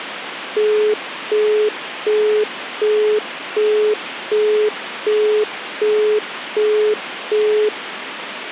Telephone call progress tone (as in the UK, Australia and similar networks), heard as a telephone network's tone, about 420 Hz, 0.375 s on and 0.375 s off, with phone line noise. Busy tone.